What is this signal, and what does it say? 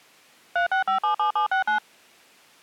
DTMF, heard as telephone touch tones, dialled by machine, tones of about 110 ms. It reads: 36577769